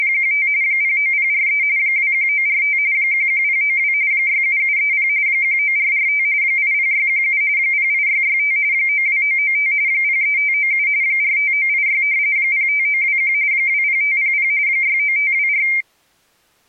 RTTY (45.45 baud, 170 Hz shift), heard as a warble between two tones, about 2200 Hz centre. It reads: … 09043 21945 11092 67730 19445 80617 08665 92995 03597 45986 05921 20500 69524